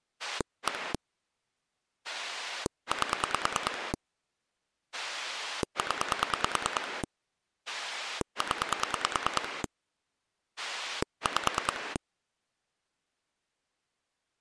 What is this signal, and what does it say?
Pulse dialling, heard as a rotary dial, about 9 pulses a second. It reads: 1 8 0 0 5